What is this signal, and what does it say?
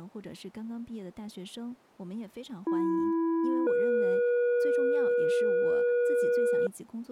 Two-tone page, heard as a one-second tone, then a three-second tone, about 330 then 480 Hz, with speech in Chinese.